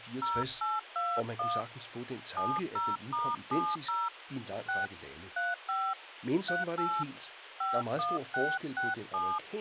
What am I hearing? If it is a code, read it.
DTMF, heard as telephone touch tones, dialled by hand, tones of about 210 ms, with phone line noise and speech in Danish. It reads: 0821 70*70 6 35 38 51667